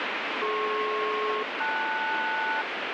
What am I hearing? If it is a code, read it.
Aircraft SELCAL, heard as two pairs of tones, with heavy radio static. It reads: DP-LS